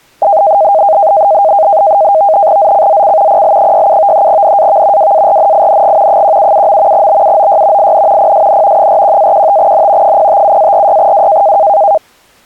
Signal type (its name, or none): NAVTEX (SITOR-B)